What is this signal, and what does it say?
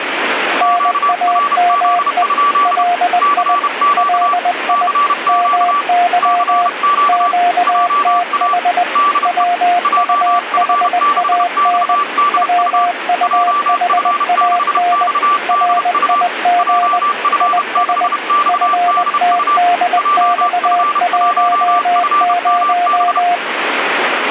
Morse code, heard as two keyed tones, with radio static. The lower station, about 20 wpm, 710 Hz: NAME LI LI MY QTH WUHAN WUHAN RIG IS FTDX10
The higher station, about 31 wpm, 1160 Hz: QRZ? CQ CQ CQ JA DE JF6XDU JF6XDU JF6XDU JF1FMB